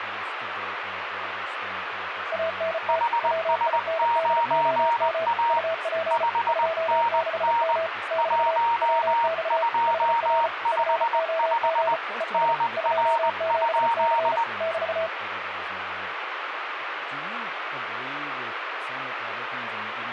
Morse code, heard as two keyed tones, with radio static and speech in English. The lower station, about 34 wpm, 650 Hz: ANT WINDOM UP 26M <BT> WX HR FOG ES 27C <BT>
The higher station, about 20 wpm, 930 Hz: HS9A 5NN 1255 NR?